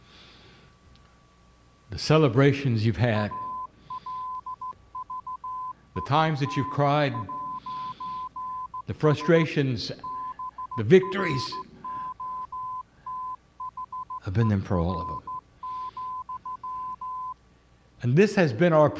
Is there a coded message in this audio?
Yes: Morse code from 3.1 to 17.4 s, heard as a keyed tone, hand-sent with a straight key, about 15 wpm, 1020 Hz. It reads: ALVIN'S BROTHER,